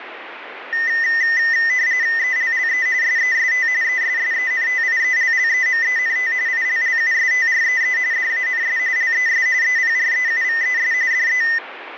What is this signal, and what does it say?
RTTY (45.45 baud, 170 Hz shift), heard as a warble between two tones, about 1900 Hz centre, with radio static. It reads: ELLE SEST ESSENTIELLEMENT ILLUSTREE DANS LES EPREUVES DE